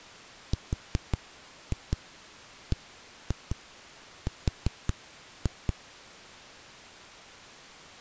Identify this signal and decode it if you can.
Tap code, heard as knocks on a wall, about 5 knocks a second. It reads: RBR